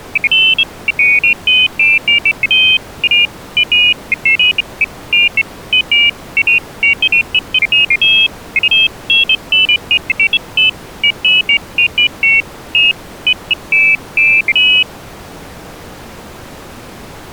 Pairs of high tones at irregular times. There is no code.